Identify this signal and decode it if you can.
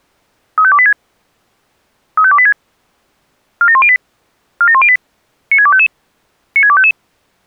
Five-tone selective call (ZVEI), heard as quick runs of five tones, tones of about 70 ms. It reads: 35286 35286 47108 47108 96255 96255